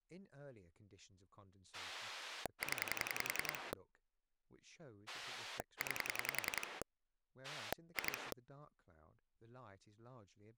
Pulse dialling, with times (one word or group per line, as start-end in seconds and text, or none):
1.7-3.7 0
5.1-6.8 9
7.4-8.3 2